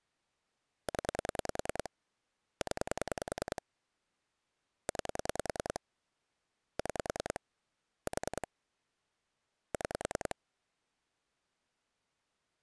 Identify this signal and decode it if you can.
Pulse dialling, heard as clicks on a phone line, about 10 pulses a second. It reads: 0 0 9 6 4 6